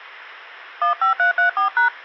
DTMF, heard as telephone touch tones, dialled by hand, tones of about 120 ms. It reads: 15334#